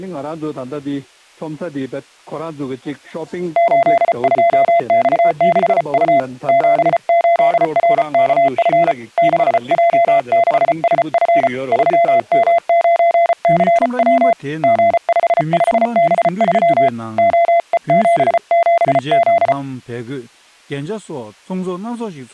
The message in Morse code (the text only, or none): 82X6U 78RKF 6J6SF 3M9CW G55B3 OE77Z